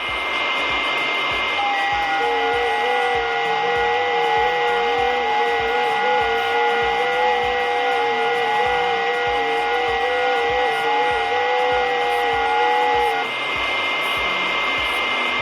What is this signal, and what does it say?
FT8 (several signals at once), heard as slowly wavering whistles, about 6.25 baud, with radio static, a steady whistle near 2100 Hz and room echo.